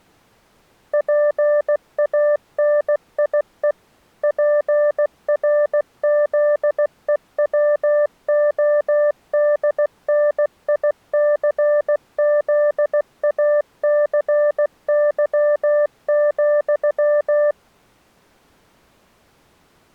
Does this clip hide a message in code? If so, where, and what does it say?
Yes: Morse code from 0.9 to 17.6 s, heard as a keyed tone, machine-sent, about 16 wpm, 590 Hz. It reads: PANIE PRZEWODNICZACY,